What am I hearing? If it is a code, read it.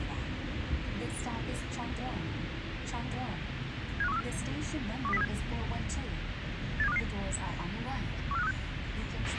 Five-tone selective call (EEA), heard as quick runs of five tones, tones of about 40 ms, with radio hiss, a squelch burst at the end and the noise inside a subway train. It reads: 75134 12037 87255 14536